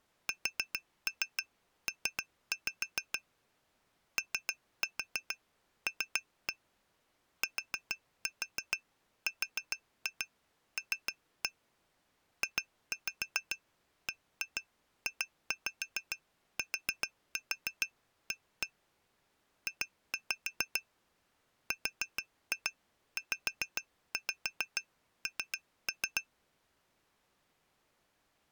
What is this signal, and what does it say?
Tap code, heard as taps on glass, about 7 knocks a second. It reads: SP OL TRL JBJTA J RZN